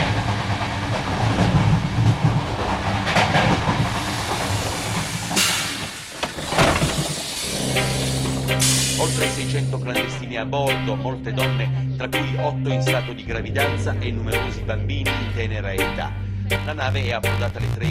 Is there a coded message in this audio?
No.